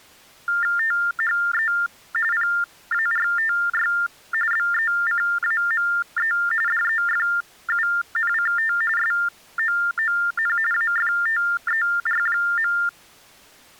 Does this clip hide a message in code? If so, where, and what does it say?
Yes: TTY/TDD text telephone tones (45.45 baud Baudot) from 0.5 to 12.9 s, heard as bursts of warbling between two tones, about 400 Hz shift, 1600 Hz centre. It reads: THE PARTY BECAME DEFUNCT SOON AFTER.